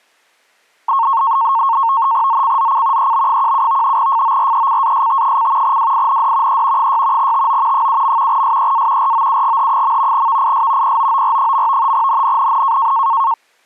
NAVTEX (SITOR-B), 100 baud, 170 Hz shift, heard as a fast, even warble, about 1000 Hz centre. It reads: ZCZC EB17 FORECAST: WIND E 6 TO 7. SEA ROUGH. VIS POOR. NNNN